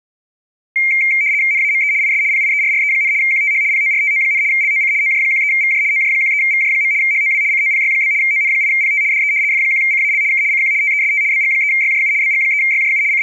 RTTY (75 baud, 170 Hz shift), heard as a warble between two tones, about 2200 Hz centre. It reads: NAME IS PIERRE, QTH PORTO, LOC OJ13VJ OJ13VJ. HOW COPY? ON8PT DE F1CAL K CQ TEST BG3YJU BG3YJU …